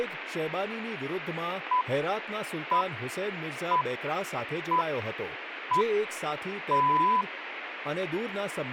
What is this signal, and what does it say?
Radio time signal (six pips, as the Greenwich Time Signal), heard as pips, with radio static and speech in Gujarati.